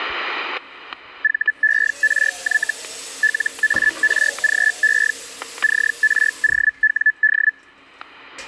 Hellschreiber (Feld-Hell, 122.5 baud), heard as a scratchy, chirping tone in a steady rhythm, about 1750 Hz, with static crashes and kitchen noise. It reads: VERY LARGE CROWD